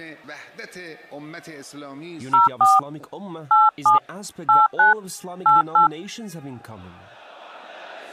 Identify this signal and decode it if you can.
DTMF, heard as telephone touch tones, dialled by hand, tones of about 160 ms. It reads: 04 87 89 88